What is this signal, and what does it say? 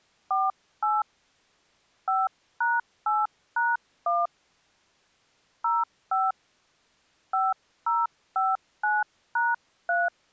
DTMF, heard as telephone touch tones, dialled by hand, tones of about 200 ms. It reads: 48 5#8#1 05 5059#3